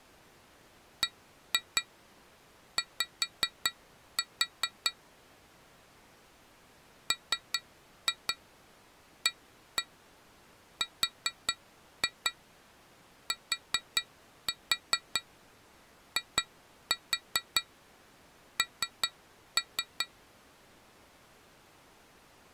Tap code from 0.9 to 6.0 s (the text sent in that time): BY